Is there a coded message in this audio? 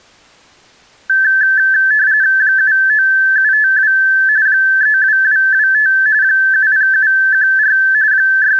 Yes: RTTY (45.45 baud, 170 Hz shift) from 1.1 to 8.6 s, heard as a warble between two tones, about 1650 Hz centre. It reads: 79752 32225 70714 …